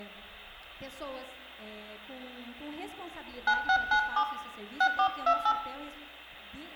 DTMF, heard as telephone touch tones, dialled by hand, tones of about 80 ms, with room echo. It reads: 9697 6428